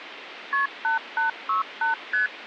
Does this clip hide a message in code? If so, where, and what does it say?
Yes: multi-frequency trunk signalling (R1, as on North American trunks) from 0.5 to 2.3 s, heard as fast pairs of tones, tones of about 130 ms, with phone line noise. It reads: KP 8868 ST